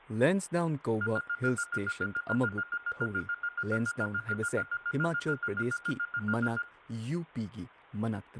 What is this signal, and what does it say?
Evenly repeated beeps, with room echo and speech in Manipuri. There is no code.